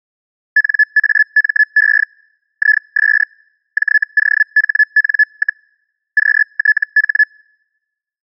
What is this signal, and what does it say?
Hellschreiber (Feld-Hell, 122.5 baud), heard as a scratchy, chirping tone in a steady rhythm, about 1700 Hz. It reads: NAME IS JOHN, QTH